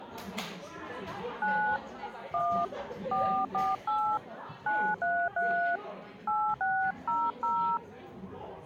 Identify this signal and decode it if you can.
DTMF, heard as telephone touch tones, dialled by hand, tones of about 300 ms, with the noise of a crowd indoors. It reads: 9 1 448 933 8600